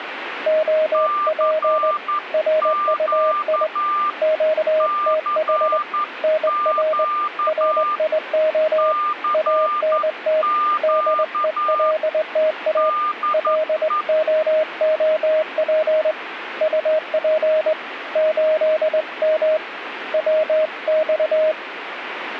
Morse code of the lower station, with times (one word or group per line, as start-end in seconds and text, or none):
0.5-1.9 OP
2.3-3.7 RUI
4.2-5.8 QTH
6.2-7.0 NR
7.5-8.9 RIO
9.3-10.4 ANT
10.8-12.9 DELTA
13.3-16.1 LOOP
16.6-17.7 UP
18.2-19.6 8M
20.1-21.5 WX